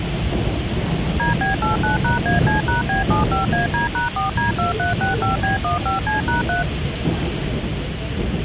DTMF, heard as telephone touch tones, dialled by machine, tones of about 140 ms, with phone line noise and the noise inside a subway train. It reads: DB89#AC#B75AD#4D2365B15C#3